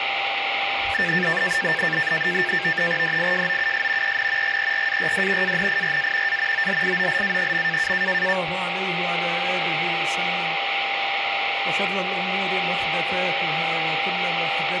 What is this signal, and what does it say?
NAVTEX (SITOR-B), 100 baud, 170 Hz shift, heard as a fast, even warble, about 1700 Hz centre, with radio static and a steady whistle near 790 Hz. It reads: DIJOUS EN GERARD ANIRA A OLIOLA.